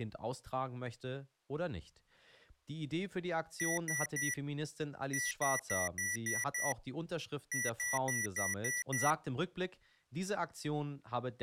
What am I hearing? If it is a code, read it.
Beep code, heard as beeps from a small speaker, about 1950 Hz, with speech in German. 3-6-6.